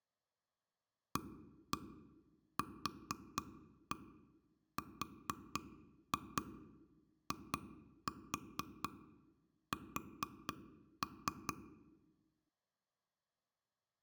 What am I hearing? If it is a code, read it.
Tap code, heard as taps on a table, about 4 knocks a second. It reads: AQRIS